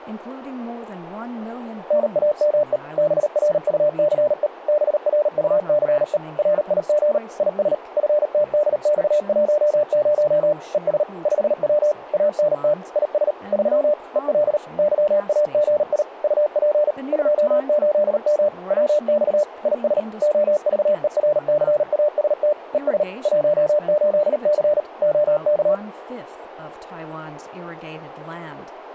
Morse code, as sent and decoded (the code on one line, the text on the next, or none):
-. .- -- . / -... .-. ..- -.-. . / -... .-. ..- -.-. . / .-. .. --. / .. ... / ..-. - -.. -..- .---- ----- / . ... / ..... .-- / .- -. - / .. ... / ...-- / . .-.. / -.-- .- --. .. / ..- .--. / ..--- ---.. -- / .-- -..- / .. ... / --- ...- . .-. -.-. .- ... - / . ... / .---- ---.. -.-. / --- -.-
NAME BRUCE BRUCE RIG IS FTDX10 ES 5W ANT IS 3 EL YAGI UP 28M WX IS OVERCAST ES 18C OK